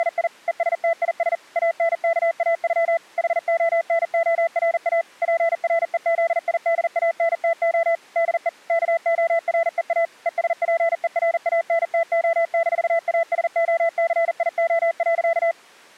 Morse code (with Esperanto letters), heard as a keyed tone, machine-sent, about 40 wpm, 670 Hz. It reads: … ESTIS ANKAŬ HONORA PREZIDANTO DE KOREA ESPERANTO-ASOCIO.